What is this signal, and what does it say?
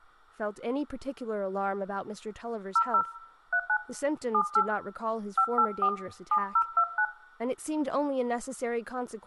DTMF, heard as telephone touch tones, dialled by hand, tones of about 70 ms, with room echo and speech in English. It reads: 00 39 78 584 7029